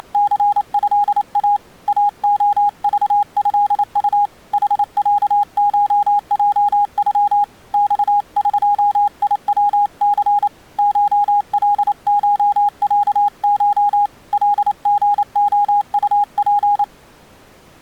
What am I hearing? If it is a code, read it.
Morse code (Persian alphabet), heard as a keyed tone, hand-sent with a paddle, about 28 wpm, 820 Hz. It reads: … اعذضط حصشجغ خقیوث شلشصش لژعطپ